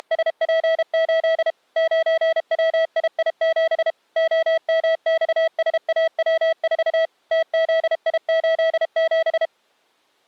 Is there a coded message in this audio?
Yes: Morse code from 0.0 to 9.5 s, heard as a keyed tone, machine-sent, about 32 wpm, 650 Hz. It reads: … 9WII7 OMXSAW4 TZI87